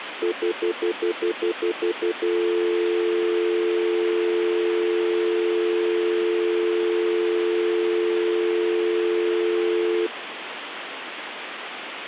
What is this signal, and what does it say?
Telephone call progress tone (North American plan), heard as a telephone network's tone, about 350, 440 Hz, 0.1 s on and 0.1 s off, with phone line noise. Stutter dial tone.